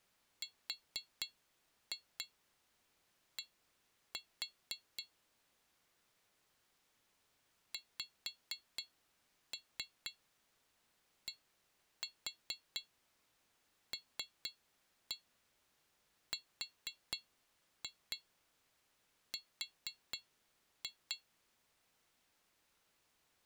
Tap code, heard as taps on glass, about 4 knocks a second. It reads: RD XDLRR